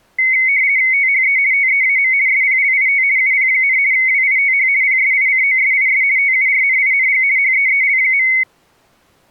RTTY (50 baud, 170 Hz shift), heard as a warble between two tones, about 2150 Hz centre. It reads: THE TEAM SPLIT UP, WITH PSICOSIS TURNING HEEL.